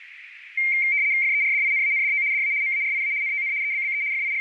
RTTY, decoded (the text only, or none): FERDINANDO DA MARIA NON EBBE …